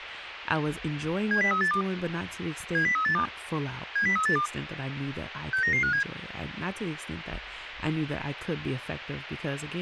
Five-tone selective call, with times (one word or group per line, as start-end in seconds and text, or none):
1.3-1.8 70382
2.7-3.2 70382
4.0-4.5 70382
5.5-6.0 69957